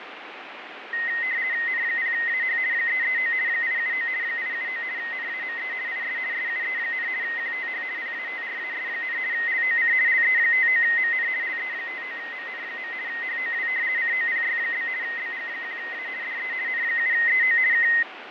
RTTY (50 baud, 170 Hz shift), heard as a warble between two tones, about 1950 Hz centre, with radio static and fading. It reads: N0AH 339 879 879 NAME IS SUE, QTH PATRAS, LOC LE59MN LE59MN. HOW COPY? BG1A DE N7EO K